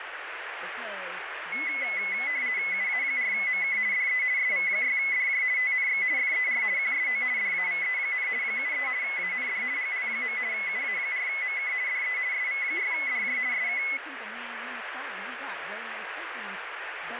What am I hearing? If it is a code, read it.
RTTY (50 baud, 170 Hz shift), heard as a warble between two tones, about 2100 Hz centre, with radio static and speech in English. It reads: UA4MK DE SV6DJ TNX FER QSO DAVE, 73 AND GL. UA4MK DE SV6DJ SK